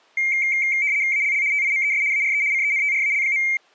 RTTY (75 baud, 170 Hz shift), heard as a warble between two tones, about 2200 Hz centre. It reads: ALL TIMES ARE CENTRAL.